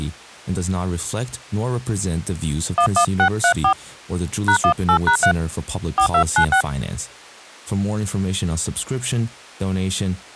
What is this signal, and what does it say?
DTMF, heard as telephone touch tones, dialled by hand, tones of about 90 ms, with speech in English. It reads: 11634 #18#3 4296